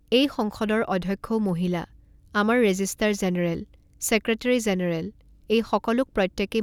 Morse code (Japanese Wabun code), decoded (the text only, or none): none